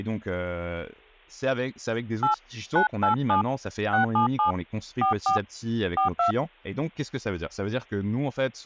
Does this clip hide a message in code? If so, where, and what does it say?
Yes: DTMF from 2.2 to 6.3 s, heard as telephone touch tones, dialled by hand, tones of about 120 ms, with speech in French. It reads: 8 987 677 44 42